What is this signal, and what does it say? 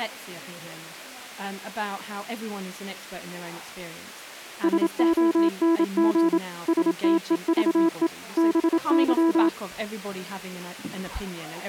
Morse code, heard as a keyed tone, machine-sent, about 27 wpm, 330 Hz. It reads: SONG STEVE BY